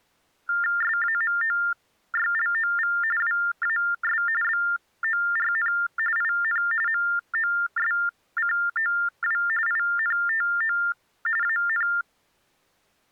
TTY/TDD text telephone tones (45.45 baud Baudot), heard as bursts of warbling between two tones, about 400 Hz shift, 1600 Hz centre. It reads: SAMOYLOV WAS BORN IN MOSCOW INTO AN